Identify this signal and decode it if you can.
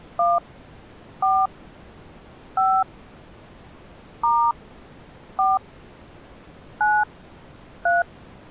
DTMF, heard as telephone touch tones, dialled by hand, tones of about 220 ms. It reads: 1 4 5 * 4 9 3